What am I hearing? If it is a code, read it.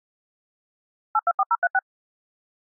DTMF, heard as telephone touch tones, dialled by machine, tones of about 40 ms. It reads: 824036